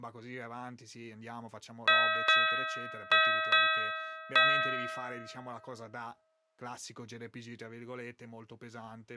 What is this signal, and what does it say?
Ship's bell, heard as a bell, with speech in Italian. 5. Five half-hours of the watch have passed.